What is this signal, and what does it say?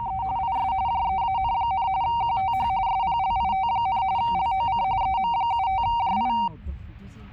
RTTY (45.45 baud, 170 Hz shift), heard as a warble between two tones, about 850 Hz centre, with the noise inside a car. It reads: … IS JEAN, QTH SPLIT, LOC EM75JI